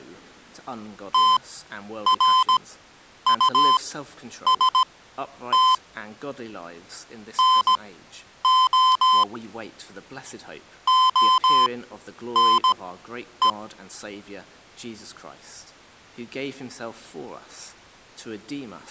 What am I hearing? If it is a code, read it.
Morse code, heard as electronic beeps, machine-sent, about 17 wpm, spaced as for 9 wpm, 1030 Hz. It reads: TRUST NO ONE